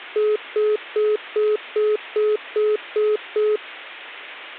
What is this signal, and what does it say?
Telephone call progress tone (single-tone plan, as in most of Europe), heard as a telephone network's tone, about 420 Hz, 0.2 s on and 0.2 s off. Congestion tone.